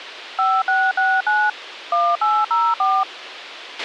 DTMF, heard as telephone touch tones, dialled by machine, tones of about 240 ms, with a squelch burst at the end. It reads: 5669 1804